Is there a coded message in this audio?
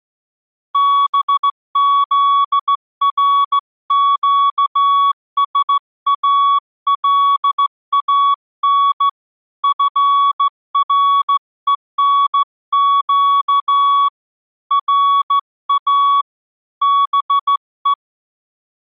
Yes: Morse code (Persian alphabet) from 0.7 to 18.0 s, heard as a keyed tone, hand-sent with a straight key, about 15 wpm, 1120 Hz. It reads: بزرگسالان فرهنگ را به